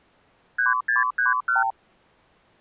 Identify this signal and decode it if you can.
Multi-frequency trunk signalling (R2, with the far end's replies), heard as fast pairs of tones, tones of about 150 ms. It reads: 3631